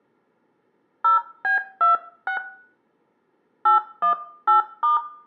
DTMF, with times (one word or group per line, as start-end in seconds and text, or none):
1.0-2.4 0B26
3.7-5.0 818*